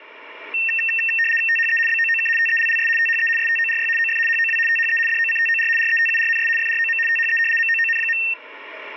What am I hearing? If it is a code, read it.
RTTY (75 baud, 850 Hz shift), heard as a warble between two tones, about 2250 Hz centre. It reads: THE BOOK TELLS THE STORY OF HOW THE DOCTOR RETURNS FROM THE MOON.